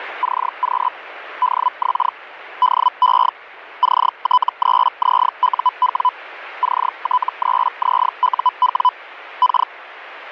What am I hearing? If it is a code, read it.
Hellschreiber (Feld-Hell, 122.5 baud), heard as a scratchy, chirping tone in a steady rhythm, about 1000 Hz, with radio static. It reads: CQ DX DE CT3ZUW CT3ZUW K